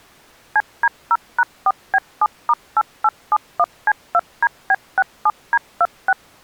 DTMF, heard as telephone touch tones, dialled by machine, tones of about 50 ms. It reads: CD0#4B7*8871C2DB67D26